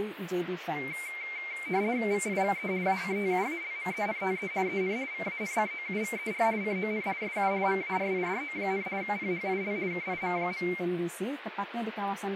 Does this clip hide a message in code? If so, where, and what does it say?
Yes: RTTY (50 baud, 170 Hz shift) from 0.8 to 10.8 s, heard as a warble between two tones, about 2200 Hz centre, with radio static. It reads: VIVE ACTUALMENTE EN VANCOUVER CON SU MARIDO, PHIL KIM.